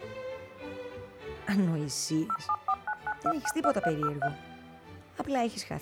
DTMF, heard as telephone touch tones, dialled by machine, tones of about 60 ms. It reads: 07499292303